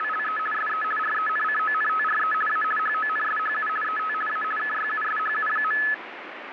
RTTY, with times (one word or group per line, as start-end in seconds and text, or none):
0.0-0.4 …
0.5-0.8 SE
1.0-2.3 RENCONTRE
2.5-2.6 A
2.8-3.7 HONSHU
3.8-4.1 ET
4.3-4.4 A
4.6-5.8 KYUSHU.